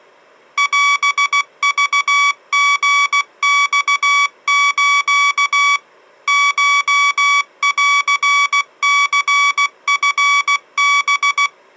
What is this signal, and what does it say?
Morse code (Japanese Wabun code), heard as electronic beeps, machine-sent, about 16 wpm, 1140 Hz. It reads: オクリマス コンニチハ